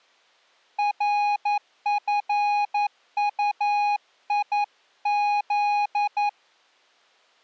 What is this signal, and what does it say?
Morse code (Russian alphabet), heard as a keyed tone, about 11 wpm, 830 Hz. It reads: РФУИЗ